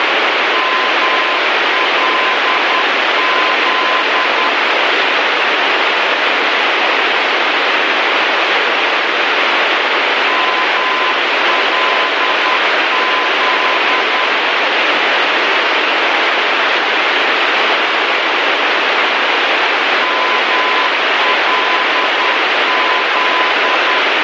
Morse code, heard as a keyed tone, machine-sent, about 10 wpm, 1020 Hz, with heavy radio static. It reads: MLZ MLZ MLZ